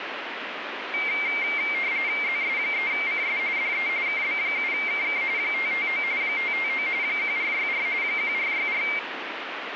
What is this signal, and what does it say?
RTTY (45.45 baud, 170 Hz shift), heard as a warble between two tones, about 2200 Hz centre, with radio static. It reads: ZS3CS DE KB7KK 559 559 1464 1464